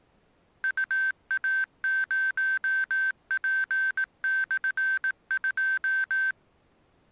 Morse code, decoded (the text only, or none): UA0P/2